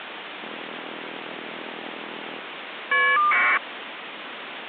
Caller ID data burst, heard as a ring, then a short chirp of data, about 1200 baud, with phone line noise.